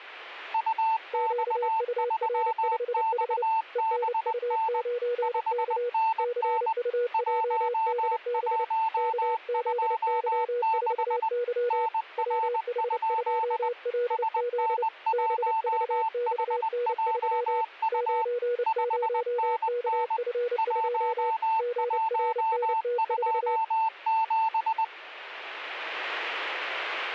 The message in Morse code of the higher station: UX3XBN 5NN 1126 NR? SN1HJU 5NN 1127

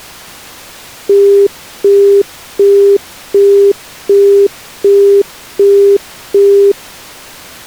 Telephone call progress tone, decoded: busy tone

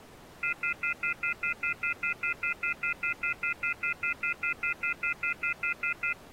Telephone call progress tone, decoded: off-hook warning tone

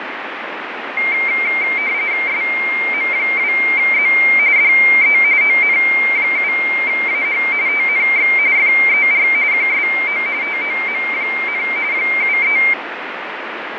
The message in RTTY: SM2Z DE ON7AH TNX FER QSO TOM, 73

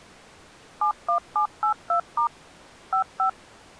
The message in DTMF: 71782* 55

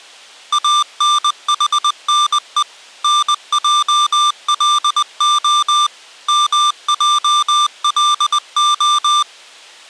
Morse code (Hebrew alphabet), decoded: אנחנו נעלה מעלה

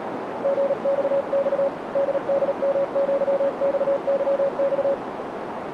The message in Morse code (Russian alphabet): ГЬЬ ДДМЪЬЫЬ

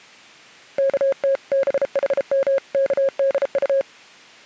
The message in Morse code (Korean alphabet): 어둠의

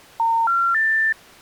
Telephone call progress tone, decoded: special information tone

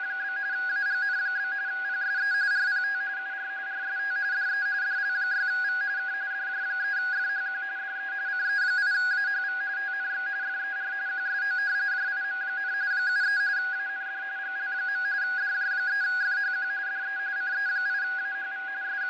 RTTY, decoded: … AGN? PSE RPT UR RST DE DL6V K DJ3FHQ DE CE8AHV TNX FER QSO JIM, 73 AND GL. DJ3FHQ DE CE8AHV …

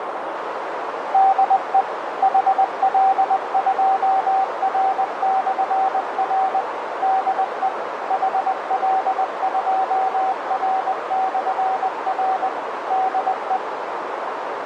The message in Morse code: DE HL2R/R DE HL2R/R DE

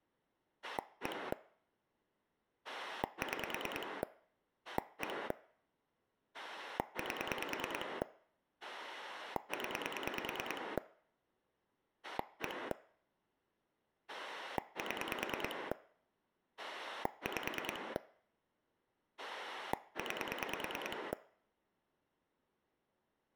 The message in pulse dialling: 1 6 1 8 0 1 7 5 9

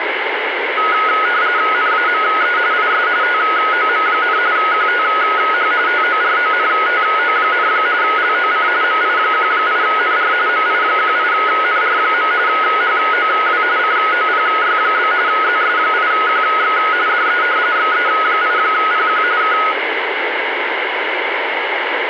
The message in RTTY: NAME IS TOM, QTH TORONTO, LOC MI18NR MI18NR. HOW COPY? ZS8QX DE XE8PQ K

